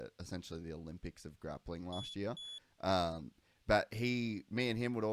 Beep code, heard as a piezo beeper, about 3400 Hz, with speech in English. 2 short. In AMI BIOS tables: memory parity error; in IBM BIOS tables: self-test error shown on screen; in Dell tables: no memory detected.